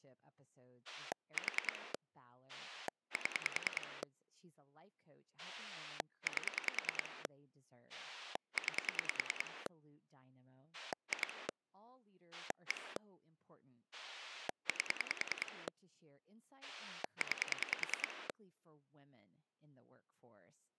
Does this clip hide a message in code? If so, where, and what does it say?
Yes: pulse dialling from 0.9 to 18.3 s, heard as a rotary dial, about 10 pulses a second, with speech in English. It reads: 4 7 8 9 2 1 8 9